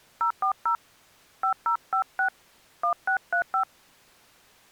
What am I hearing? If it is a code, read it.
DTMF, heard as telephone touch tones, dialled by hand, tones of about 100 ms. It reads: 040 5056 1635